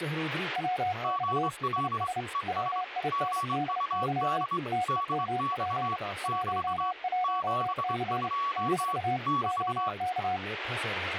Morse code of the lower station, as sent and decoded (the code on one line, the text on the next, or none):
.-- -..- / .. ... / .-- .. -. -.. -.-- / - . -- .--. / .---- .---- -.-. / -....- / --- -.-
WX IS WINDY TEMP 11C - OK